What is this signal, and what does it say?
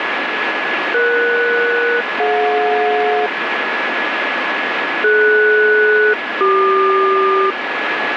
Aircraft SELCAL, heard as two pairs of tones, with radio static. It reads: ES-DJ DS-CQ